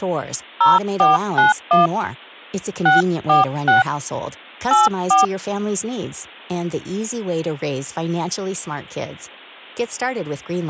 DTMF, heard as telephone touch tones, dialled by hand, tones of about 140 ms, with speech in Swedish. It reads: 0491 646 84